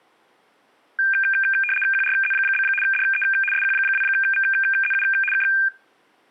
RTTY (75 baud, 850 Hz shift), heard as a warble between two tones, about 2000 Hz centre. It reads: QRZ? DE SQ2VZU K